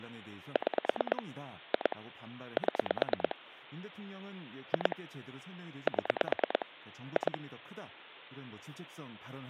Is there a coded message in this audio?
Yes: pulse dialling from 0.6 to 7.4 s, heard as clicks on a phone line, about 9 pulses a second, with hum and speech in Korean. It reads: 6 2 7 2 7 2